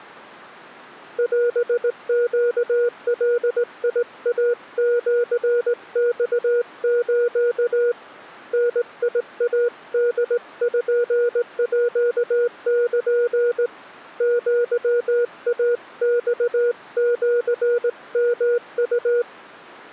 Morse code (Japanese Wabun code), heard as a keyed tone, hand-sent with a straight key, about 18 wpm, 480 Hz. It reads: オネガイシマス ダイポール アイマシヨウ